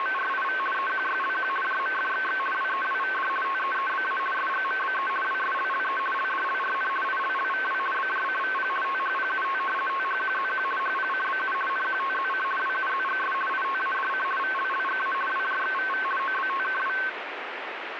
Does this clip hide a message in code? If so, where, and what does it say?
Yes: RTTY (50 baud, 450 Hz shift) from 0.0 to 17.1 s, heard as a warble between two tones, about 1310 Hz centre, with radio static. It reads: … EQYLQ JMFXX WEWVD TEEBA SGMBE WSLLE LDLRN ILLVW BJCVP THPUT THQZQ HPCBU NQTZC WUZGS ITADC VLLGA WJXVV OBTKW